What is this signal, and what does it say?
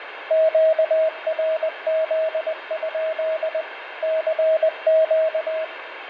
Morse code, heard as a keyed tone, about 20 wpm, 640 Hz, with radio static, fading and room echo. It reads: QRZ? CQ